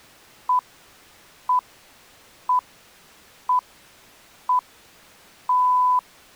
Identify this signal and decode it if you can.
Radio time signal (six pips, as the Greenwich Time Signal), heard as pips.